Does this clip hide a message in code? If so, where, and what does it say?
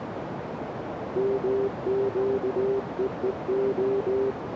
Yes: Morse code (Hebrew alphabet) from 1.1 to 4.4 s, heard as a keyed tone, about 19 wpm, 400 Hz, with radio static and a narrow filter. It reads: מקווה